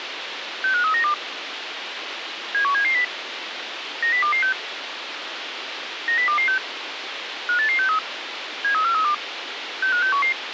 Five-tone selective call (CCIR), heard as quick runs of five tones, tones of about 100 ms, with radio hiss. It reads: 65392 71770 90226 90226 58863 73432 65611